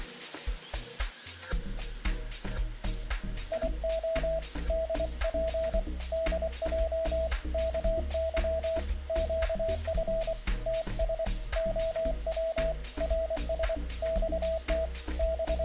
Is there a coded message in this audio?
Yes: Morse code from 3.5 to 15.6 s, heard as a keyed tone, hand-sent with a paddle, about 24 wpm, 650 Hz. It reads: IO DP DJ KY QF TS OW RS XT …